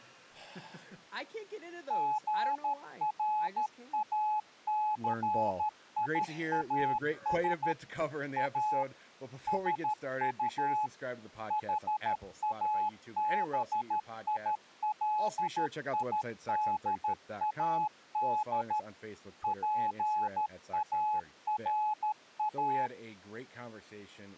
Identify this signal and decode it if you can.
Morse code, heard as a keyed tone, machine-sent, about 13 wpm, 850 Hz, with speech in English. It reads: GRACIAS A SU HABILIDAD PARA